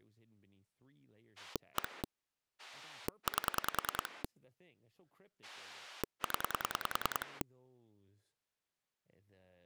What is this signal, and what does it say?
Pulse dialling, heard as a rotary dial, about 10 pulses a second, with speech in English. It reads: 1 8 0